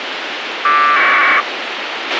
Packet radio (AX.25, as in APRS), 1200 baud, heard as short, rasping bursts, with radio hiss and a squelch burst at the end.